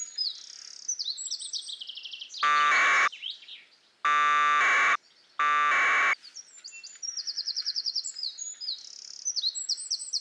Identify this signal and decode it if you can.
Packet radio (AX.25, as in APRS), 1200 baud, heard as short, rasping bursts.